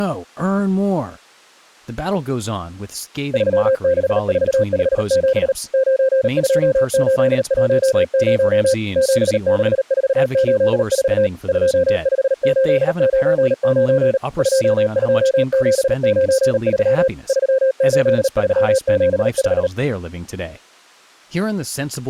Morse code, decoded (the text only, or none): 36457 92810 76484 25899 22793 38375